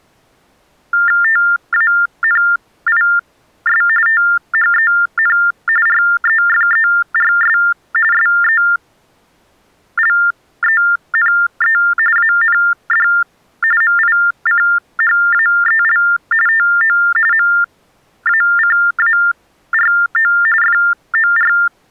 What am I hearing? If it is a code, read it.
TTY/TDD text telephone tones (45.45 baud Baudot), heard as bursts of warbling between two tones, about 400 Hz shift, 1600 Hz centre. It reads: TANIS THEN REFERS SELENE AND MICHAEL TO MACARO FOR